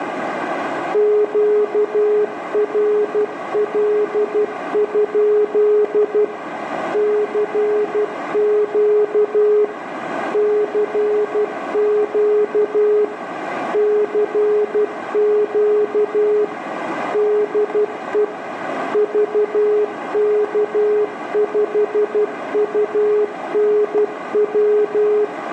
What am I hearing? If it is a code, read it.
Morse code, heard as a keyed tone, machine-sent, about 12 wpm, 420 Hz, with radio static, a narrow filter and room echo. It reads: QRL? CQ CQ CQ DE VK5UNW